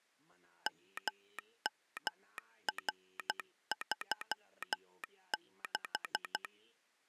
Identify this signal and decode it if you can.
Morse code, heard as a telegraph sounder, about 12 wpm. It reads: MMR36